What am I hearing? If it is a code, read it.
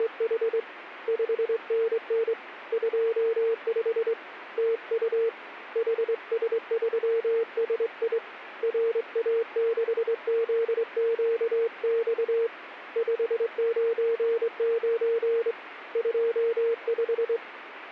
Morse code, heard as a keyed tone, hand-sent with a straight key, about 23 wpm, 460 Hz, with radio static. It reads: … 5NN 25 TU HS3SI RA6ZQX 599 25